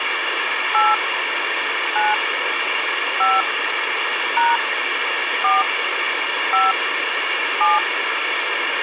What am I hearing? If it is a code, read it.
DTMF, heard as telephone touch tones, dialled by hand, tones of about 190 ms, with radio hiss. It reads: 8 9 5 # 4 5 7